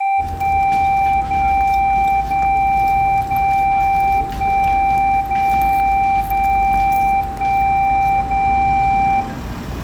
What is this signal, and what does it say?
Radio time signal (DCF77), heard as a tone whose level steps once a second, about 780 Hz, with room echo and the noise of a residential street. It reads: 1 0 0 0 1 0 0 1 0